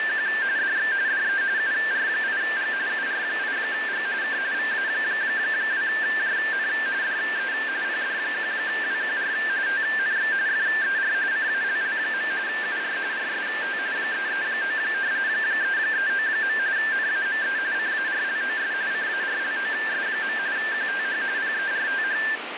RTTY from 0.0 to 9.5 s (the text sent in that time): … DX DE UR8G UR8G K VA2JN DE PD1WQR